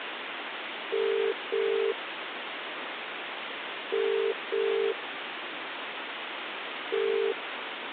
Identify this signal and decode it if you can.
Telephone call progress tone (as in the UK, Ireland, Australia and similar networks), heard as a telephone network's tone, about 400, 450 Hz, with phone line noise. Ringback tone.